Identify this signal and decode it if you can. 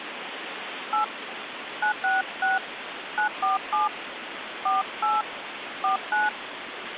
DTMF, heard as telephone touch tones, dialled by hand, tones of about 130 ms, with phone line noise. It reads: 8 966 947 48 49